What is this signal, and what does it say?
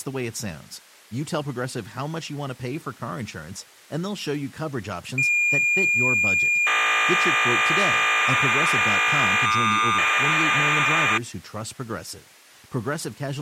Cassette data (Kansas City type), 1200 baud, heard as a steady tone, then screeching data, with speech in English.